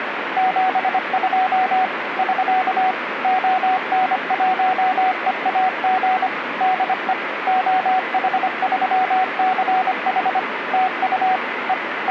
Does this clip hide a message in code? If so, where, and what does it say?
Yes: Morse code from 0.3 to 12.1 s, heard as a keyed tone, machine-sent, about 25 wpm, 750 Hz, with radio static. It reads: 72 <SK> ON1EAG DE OH3CH TU E …